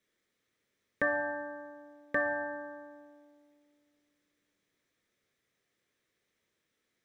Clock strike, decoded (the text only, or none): 2